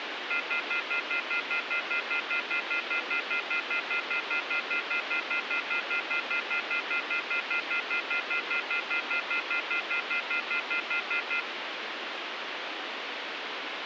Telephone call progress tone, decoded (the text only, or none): off-hook warning tone